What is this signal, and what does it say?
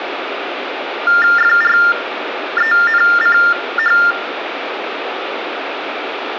TTY/TDD text telephone tones (45.45 baud Baudot), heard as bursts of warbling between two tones, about 400 Hz shift, 1600 Hz centre, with phone line noise. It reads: FRENCH